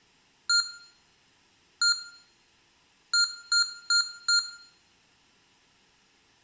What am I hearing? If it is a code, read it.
Beep code, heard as beeps from a small speaker, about 1400 Hz, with room echo. 1-1-4. In Phoenix BIOS tables: BIOS ROM checksum failure.